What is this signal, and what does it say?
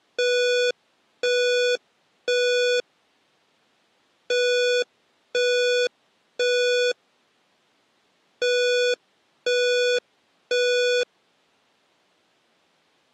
Alarm pattern, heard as an alarm's beeps, played three times, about 490 Hz. Temporal three. Smoke or fire, evacuate.